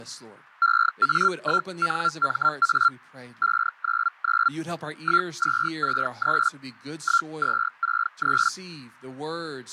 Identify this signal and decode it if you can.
Hellschreiber (Feld-Hell, 122.5 baud), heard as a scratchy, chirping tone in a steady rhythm, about 1380 Hz, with speech in English. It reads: EA1NMA 599 1263 1263